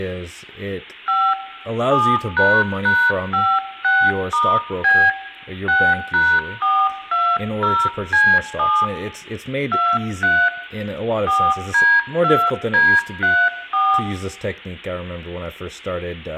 DTMF, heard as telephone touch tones, dialled by hand, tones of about 260 ms, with room echo and speech in English. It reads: 5 7##56*B 6#420C7 23 4D2D34